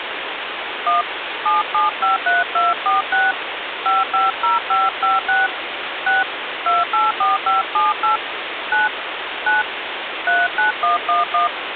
DTMF, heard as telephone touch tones, dialled by hand, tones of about 160 ms, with phone line noise. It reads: 1 7753246 550556 6 284578 9 9 39111